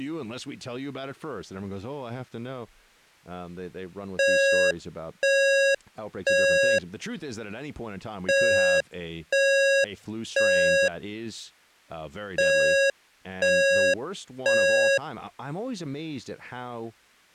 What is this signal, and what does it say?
Alarm pattern, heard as an alarm's beeps, played three times, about 550 Hz, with speech in English. Temporal three. Smoke or fire, evacuate.